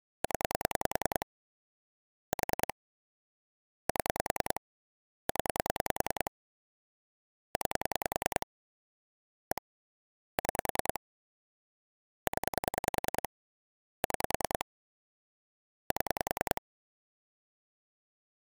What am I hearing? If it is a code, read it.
Pulse dialling, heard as clicks on a phone line, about 10 pulses a second. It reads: 0 4 7 0 9 1 6 0 6 7